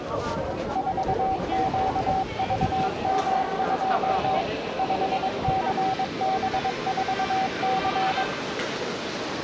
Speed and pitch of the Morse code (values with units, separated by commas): 22 wpm, 760 Hz